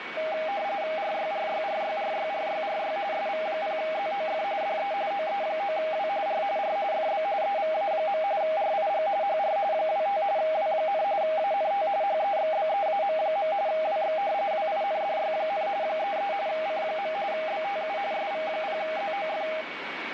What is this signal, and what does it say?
RTTY (45.45 baud, 170 Hz shift), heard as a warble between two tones, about 720 Hz centre, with radio static and a steady whistle near 2240 Hz. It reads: RYRYRYRYRYRY SV0ZOF DE OE9W R R FB EVA. RIG HR 25 W, ANT HEXBEAM. WX WINDY, 33 C. BTU SV0ZOF